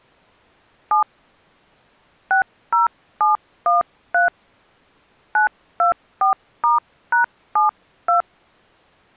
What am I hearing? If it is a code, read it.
DTMF, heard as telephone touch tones, dialled by hand, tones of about 130 ms. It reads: 7 60713 924*#72